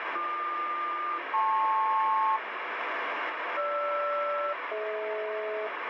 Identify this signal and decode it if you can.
Aircraft SELCAL, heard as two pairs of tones, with radio static. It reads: BQ-LP GR-DH